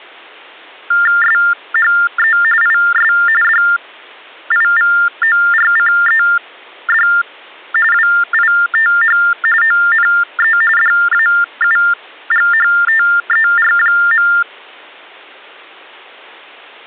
TTY/TDD text telephone tones (45.45 baud Baudot), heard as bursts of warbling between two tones, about 400 Hz shift, 1600 Hz centre. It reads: SHE IS DIVORCED WITH ONE DAUGHTER.